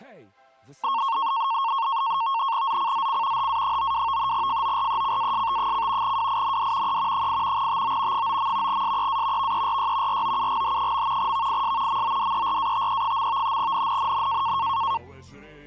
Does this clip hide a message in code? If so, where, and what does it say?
Yes: NAVTEX (SITOR-B), 100 baud, 170 Hz shift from 0.8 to 15.0 s, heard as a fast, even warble, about 1000 Hz centre. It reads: ZCZC HA92 FORECAST: WIND E 8 TO 9. SEA VERY ROUGH. VIS MODERATE. NNNN